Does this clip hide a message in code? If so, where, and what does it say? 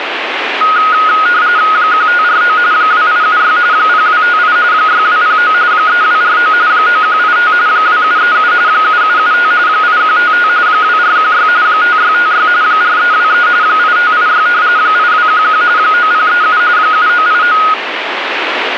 Yes: RTTY (45.45 baud, 170 Hz shift) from 0.6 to 17.7 s, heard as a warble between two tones, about 1350 Hz centre, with radio static. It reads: 1549 2876 0258 6209 3249 9185 2737 7775 8155 2416 5656 4323 8586 8211 9037 7989